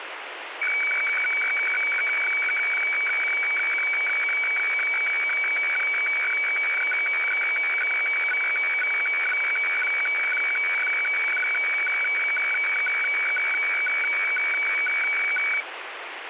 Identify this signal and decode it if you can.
Weather fax (radiofax), 120 lines a minute, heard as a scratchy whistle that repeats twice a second, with radio static.